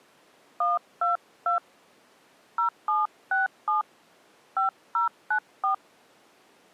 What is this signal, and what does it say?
DTMF, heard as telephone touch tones, dialled by hand, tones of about 140 ms. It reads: 122 0767 5094